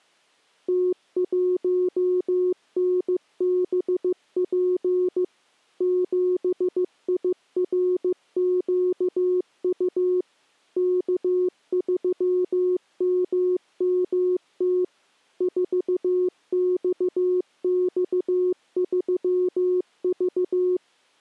Morse code, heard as a keyed tone, machine-sent, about 15 wpm, 360 Hz. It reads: T1NBP 7IRQU K3MMT 4XX3V